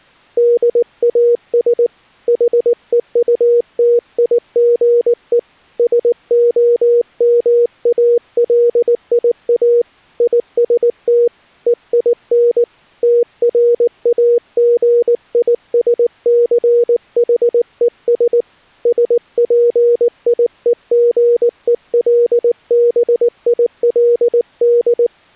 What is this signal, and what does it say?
Morse code, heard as a keyed tone, hand-sent with a paddle, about 19 wpm, 480 Hz. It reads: DAS HEUTIGE SOMALIA IST EIN TRAGISCHES SPIEGELBILD